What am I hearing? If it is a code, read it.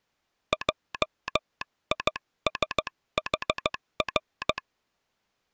Morse code, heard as a telegraph sounder, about 15 wpm. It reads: JISHR